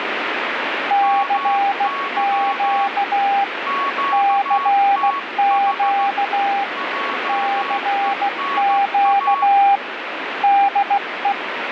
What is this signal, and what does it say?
Morse code, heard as two keyed tones, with radio static. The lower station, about 16 wpm, 800 Hz: CQ CQ CQ DE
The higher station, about 15 wpm, 1110 Hz: MY QTH JENA